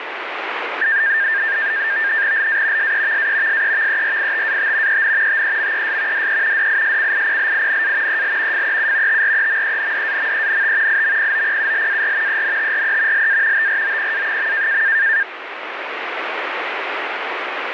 NAVTEX (SITOR-B), 100 baud, 170 Hz shift, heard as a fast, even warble, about 1700 Hz centre, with radio static. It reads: LA SEVA SEVERITAT EN TEMES DE DISCIPLINA EL FEU TREMENDAMENT IMPOPULAR ENTRE LA TROPA.